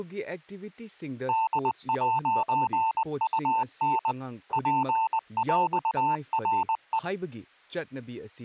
Morse code (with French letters), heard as a keyed tone, machine-sent, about 20 wpm, 890 Hz, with speech in Manipuri. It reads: D'UN PÈRE